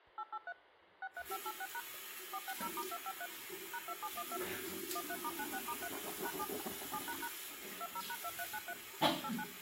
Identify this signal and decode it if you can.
DTMF, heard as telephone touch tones, dialled by machine, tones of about 60 ms, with the noise of a restroom. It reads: 883 63586# 460*253 #2712 13*96*3 #7 7## 20#2393 89